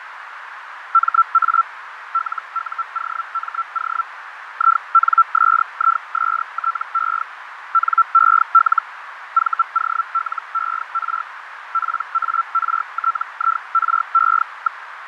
Hellschreiber (Feld-Hell, 122.5 baud), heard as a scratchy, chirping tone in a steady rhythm, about 1340 Hz, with radio static, fading and a narrow filter. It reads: MA LUOMO INSISTE NEL VOLER PARTIRE.